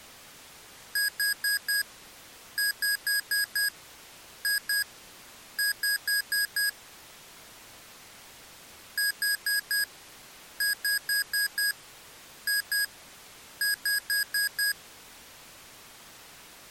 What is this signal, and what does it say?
Beep code, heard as beeps from a small speaker, played twice, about 1650 Hz. 4-5-2-5.